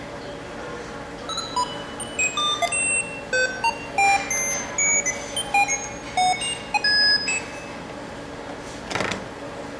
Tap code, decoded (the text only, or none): none